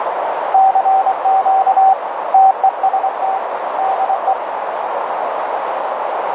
Morse code, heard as a keyed tone, hand-sent with a paddle, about 24 wpm, 770 Hz, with heavy radio static and a narrow filter. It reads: CQ TEST DE